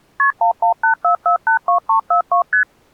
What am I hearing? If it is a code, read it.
Multi-frequency trunk signalling (R1, as on North American trunks), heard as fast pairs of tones, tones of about 110 ms. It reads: KP 1184482342 ST